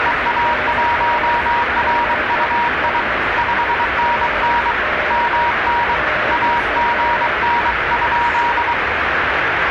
Morse code, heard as two keyed tones, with radio static and the noise of a residential street. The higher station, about 23 wpm, 950 Hz: EA1RUI 5NN MN AGN?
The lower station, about 10 wpm, 610 Hz: MNI TNX